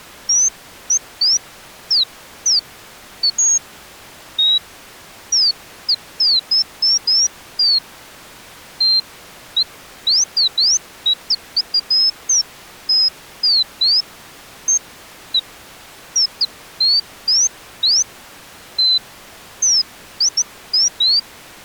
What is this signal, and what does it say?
Bird-like chirps. There is no code.